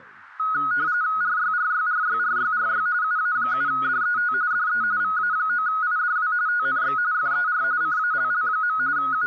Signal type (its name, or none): RTTY